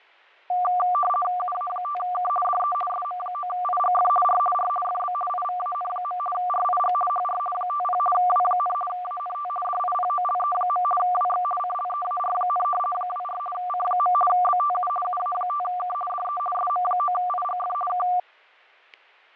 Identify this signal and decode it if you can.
RTTY (50 baud, 450 Hz shift), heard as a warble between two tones, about 950 Hz centre, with fading and static crashes. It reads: UA5K DE SM9IGF R R FB IVAN. RIG HR 50 W, ANT DIPOLE. WX CLEAR, 24 C. BTU UA5K DE SM9IGF K